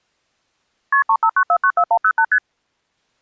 Multi-frequency trunk signalling (R1, as on North American trunks), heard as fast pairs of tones, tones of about 70 ms. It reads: KP 359494108 ST